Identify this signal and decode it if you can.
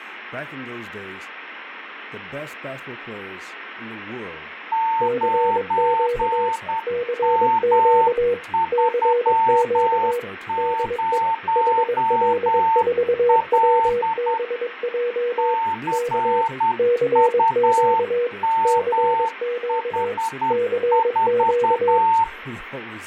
Morse code, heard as two keyed tones, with radio static, fading and speech in English. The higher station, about 10 wpm, 900 Hz: 9M30L CUMH4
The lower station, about 22 wpm, 480 Hz: CQ CQ CQ DE HL4WBJ K CQ CQ CQ